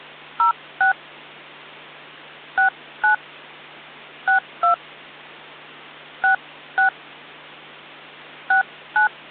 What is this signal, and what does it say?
DTMF, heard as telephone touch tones, dialled by hand, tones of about 110 ms, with hum. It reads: 06 69 62 66 69